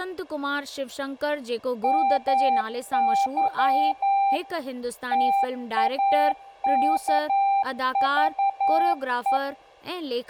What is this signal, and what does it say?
Morse code (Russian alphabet), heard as a keyed tone, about 11 wpm, 790 Hz, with room echo and speech in Sindhi. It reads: МЫ ТАКЖЕ